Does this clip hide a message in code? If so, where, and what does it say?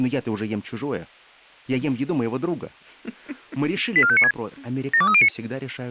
Yes: five-tone selective call (ZVEI) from 4.0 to 5.3 s, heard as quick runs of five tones, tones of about 70 ms, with speech in Russian. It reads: 84596 72309